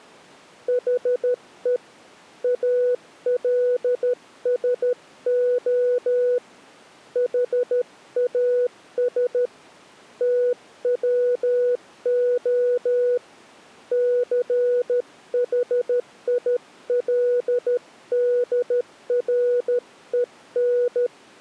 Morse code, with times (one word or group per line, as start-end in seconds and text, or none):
0.7-1.8 HE
2.4-6.4 ALSO
7.2-9.5 HAS
10.2-13.2 TWO
13.9-21.1 CHILDREN